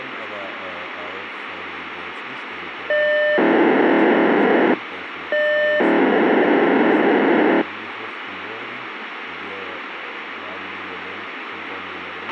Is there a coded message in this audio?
Yes: POCSAG pager data (1200 baud) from 2.9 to 7.6 s, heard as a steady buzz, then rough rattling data, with radio hiss and a squelch burst at the end.